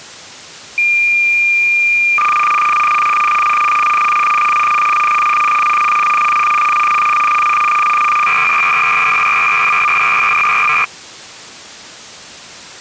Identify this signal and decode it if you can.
Cassette data (Kansas City type), 300 baud, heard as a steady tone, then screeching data.